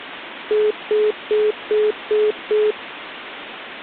Telephone call progress tone (single-tone plan, as in most of Europe), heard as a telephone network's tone, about 420 Hz, 0.2 s on and 0.2 s off. Congestion tone.